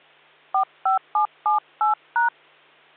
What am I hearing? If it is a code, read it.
DTMF, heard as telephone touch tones, dialled by hand, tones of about 120 ms, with hum. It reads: 45778#